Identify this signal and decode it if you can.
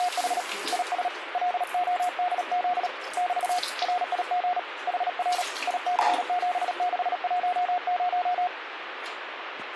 Morse code, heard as a keyed tone, hand-sent with a paddle, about 37 wpm, 720 Hz, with radio static and the noise of a restroom. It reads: … IS LODZ <BT> RIG HR IC7610